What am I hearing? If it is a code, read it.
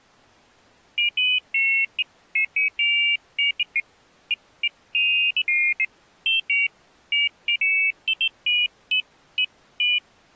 Pairs of high tones at irregular times. There is no code.